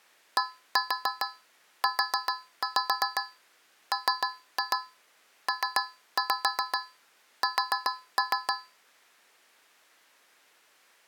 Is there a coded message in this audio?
Yes: tap code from 0.4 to 8.8 s, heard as taps on a metal pipe, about 7 knocks a second. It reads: DUMPS